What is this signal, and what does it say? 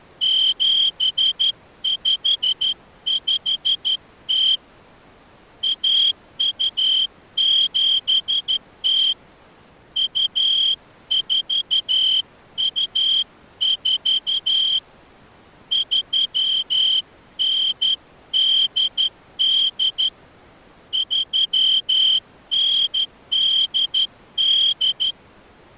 Morse code (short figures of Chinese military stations), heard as a whistle, hand-sent with a straight key, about 12 wpm. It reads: 7550 1270 2424 3988 3988